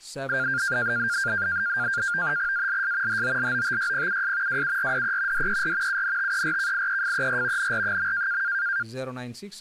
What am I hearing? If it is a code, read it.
NAVTEX (SITOR-B), 100 baud, 170 Hz shift, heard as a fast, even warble, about 1500 Hz centre, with speech in Filipino. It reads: ALS HOLOTYPUS WURDE DER UNTERKIEFER NR.